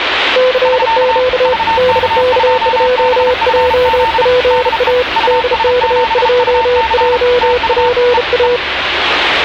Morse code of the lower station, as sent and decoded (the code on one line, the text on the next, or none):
-.-. --.- / -.. -.- ..--- .--- .--. .- / -.. -.- ..--- .--- .--. .-
CQ DK2JPA DK2JPA